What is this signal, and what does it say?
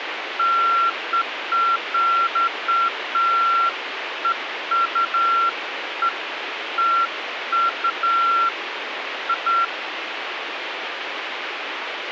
Beeps of irregular length, with radio hiss. There is no code.